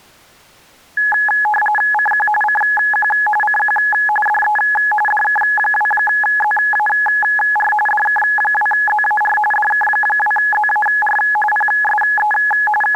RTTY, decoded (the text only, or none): CQ CQ CQ DE DK2ZAR DK2ZAR DK2ZAR PSE …